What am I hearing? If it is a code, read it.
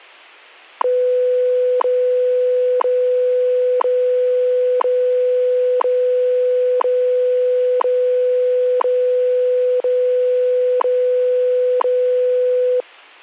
Radio time signal (WWV, Colorado), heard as ticks, one a second.